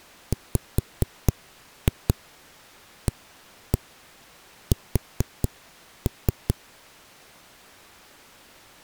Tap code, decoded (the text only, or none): WAS